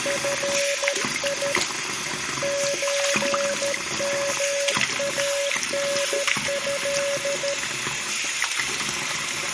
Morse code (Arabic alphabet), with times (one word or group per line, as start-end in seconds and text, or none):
0.1-1.5 في
2.4-7.5 زمانه